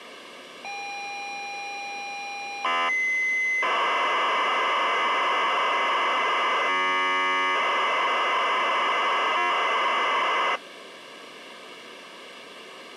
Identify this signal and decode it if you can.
ZX Spectrum tape loading, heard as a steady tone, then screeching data.